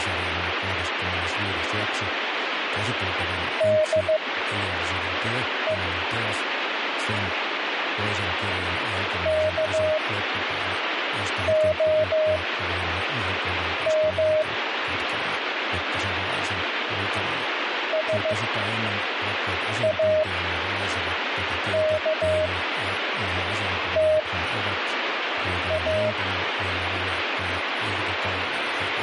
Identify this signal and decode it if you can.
Morse code, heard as a keyed tone, machine-sent, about 15 wpm, spaced as for 5 wpm, 620 Hz, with radio static and speech in Finnish. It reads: DE KOM SAKTA